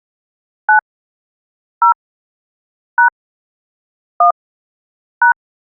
DTMF, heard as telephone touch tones, dialled by hand, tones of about 100 ms. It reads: 9 0 # 1 #